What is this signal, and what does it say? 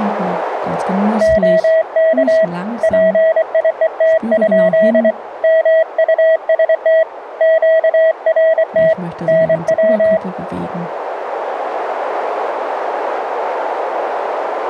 Morse code, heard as a keyed tone, hand-sent with a paddle, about 24 wpm, 650 Hz, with radio static and a narrow filter. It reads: OK PIET? MUST QRT NW